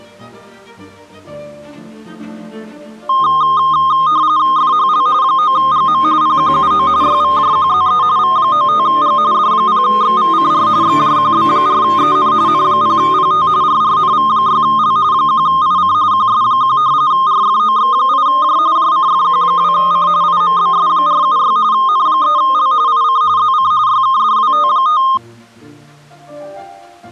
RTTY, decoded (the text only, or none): FHL 9GM PQUO YVJQZE V95G D0XVCR XJQB4EN N0PT RRNV6L 1IC QS1 RFOX8J JCFQ2C IMBS476 N3L IC ZC YKDWT5